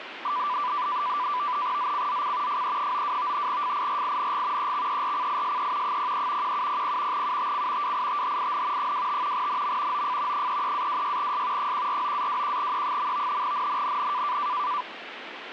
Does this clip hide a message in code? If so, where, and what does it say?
Yes: NAVTEX (SITOR-B), 100 baud, 170 Hz shift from 0.2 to 14.8 s, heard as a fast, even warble, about 1080 Hz centre, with radio static. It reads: ZCZC FE92 FIRING EXERCISE 03 1700 UTC WITHIN 25 NM OF 33-26S 149-21E. NNNN